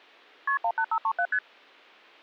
Multi-frequency trunk signalling (R1, as on North American trunks), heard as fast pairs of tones, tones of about 70 ms. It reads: KP 18537 ST